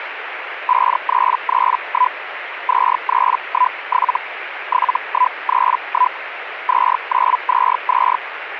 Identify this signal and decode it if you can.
Hellschreiber (Feld-Hell, 122.5 baud), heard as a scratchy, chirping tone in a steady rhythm, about 1000 Hz, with radio static. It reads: 5331 2317 7131 2922